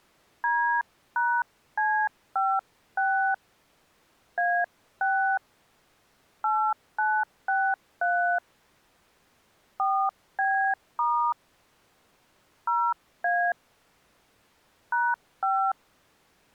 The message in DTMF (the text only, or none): D#C56 A6 8963 4B* 0A #5